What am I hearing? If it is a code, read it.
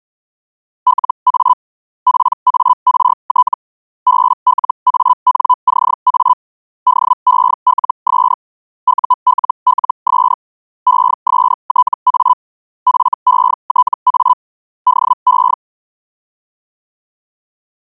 Hellschreiber (Feld-Hell, 122.5 baud), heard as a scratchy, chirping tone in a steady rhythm, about 1000 Hz. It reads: LA PART BLANCA DELS ULLS ESTA FETA DE